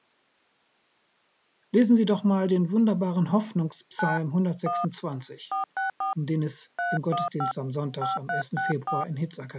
DTMF, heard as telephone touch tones, dialled by hand, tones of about 140 ms. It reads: 9 1 464 315 5364